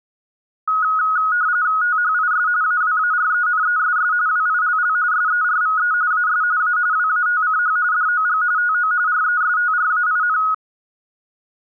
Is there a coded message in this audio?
Yes: RTTY (45.45 baud, 170 Hz shift) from 0.7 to 10.5 s, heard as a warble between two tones, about 1360 Hz centre. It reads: THIS AWARENESS WILL SERVE AS A WATCH DOG TO RESTRAIN